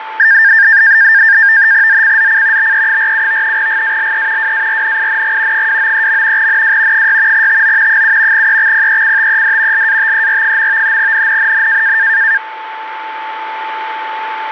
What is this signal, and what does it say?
NAVTEX (SITOR-B), 100 baud, 170 Hz shift, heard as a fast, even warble, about 1700 Hz centre, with radio static and a steady whistle near 880 Hz. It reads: ZCZC BE47 GALE WARNING 293. NW 6 TO 7 EXPECTED LATER. NNNN